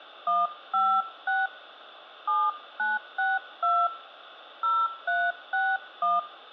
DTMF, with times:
0.3-1.5 156
2.3-3.9 7962
4.6-6.2 0361

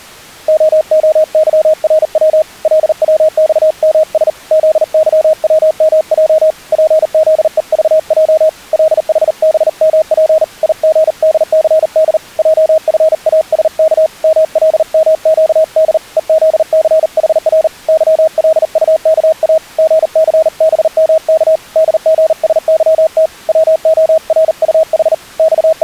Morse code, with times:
0.5-2.4 OOYRW
2.6-4.3 LWXMS
4.5-6.5 ZYWMJ
6.7-8.5 PZEVJ
8.7-10.4 LHBMP
10.6-12.2 IGDCD
12.4-14.1 JFASK
14.2-16.0 MLMQD
16.2-17.7 EZCHR
17.9-19.6 YLUKA
19.8-21.6 GCBMK
21.8-23.3 DGSYT
23.5-25.1 WORUH
25.4-25.8 …

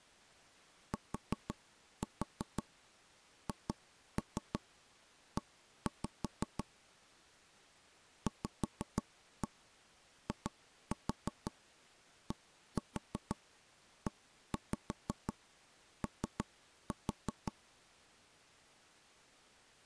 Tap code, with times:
0.9-6.6 THE
8.3-17.5 VIDEO

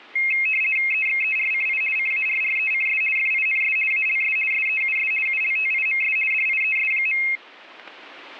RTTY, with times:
0.9-1.8 EXERCI
2.0-3.0 CARRECS
3.2-3.8 FINS
3.9-4.4 ALS
4.5-5.1 SEUS
5.3-6.2 ULTIMS
6.3-7.2 DIES.

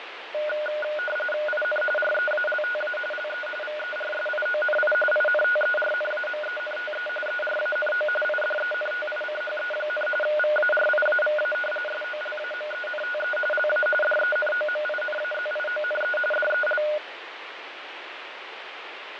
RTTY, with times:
1.5-1.8 IN
2.0-3.0 REALTA
3.1-3.5 LE
3.6-4.9 VERSIONI
5.1-7.1 INTERNAMENTE
7.3-8.1 ERANO
8.2-10.1 IDENTICHE,
10.2-11.5 VARIAVA
11.9-13.4 SOLAMENTE
13.5-13.9 LA
14.0-16.2 DENOMINAZIONE
16.3-16.8 DEL

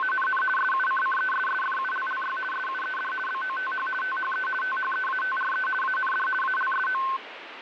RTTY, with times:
0.0-0.4 …
0.6-2.4 SUCCESSFULLY
2.5-3.1 SUED
3.3-3.9 BOTH
4.0-4.5 THE
4.6-5.7 THEATRE
5.8-6.3 AND
6.4-7.0 ALSO

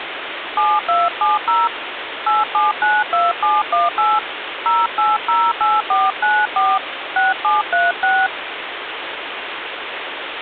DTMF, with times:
0.6-1.7 7270
2.3-4.2 8792718
4.7-6.8 0808494
7.2-8.3 6736

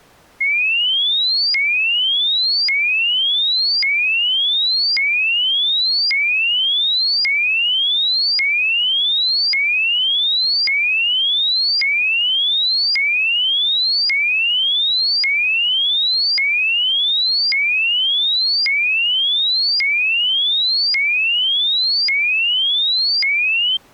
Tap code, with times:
none

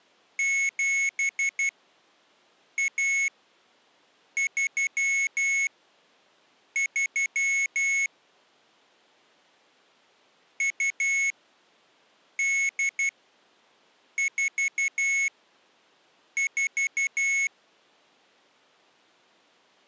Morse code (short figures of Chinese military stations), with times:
0.4-8.1 7133
10.6-17.5 2844

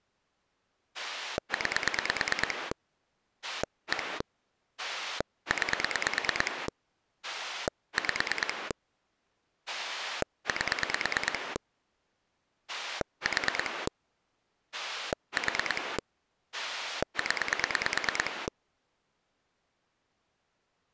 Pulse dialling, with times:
0.9-2.7 9
3.4-4.2 1
4.8-6.7 9
7.2-8.7 5
9.7-11.6 8
12.7-13.9 4
14.7-16.0 4
16.5-18.5 0

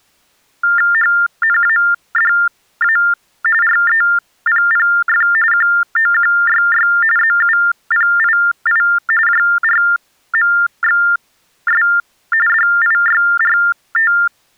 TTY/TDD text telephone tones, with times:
0.9-3.0 HNADA
3.6-5.3 REPPF
5.5-6.9 QOQYY
7.2-8.8 ZUPII
9.3-11.8 JRMXS
12.5-14.1 DIYRT

